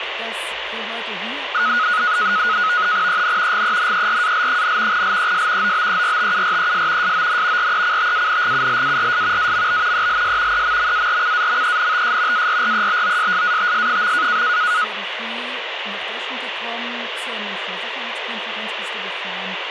NAVTEX (SITOR-B), 100 baud, 170 Hz shift, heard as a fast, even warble, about 1360 Hz centre, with radio static. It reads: EN GENERAL, LES OBERTURES SON RECTANGULARS AMB ELS EMMARCAMENTS ARREBOSSATS.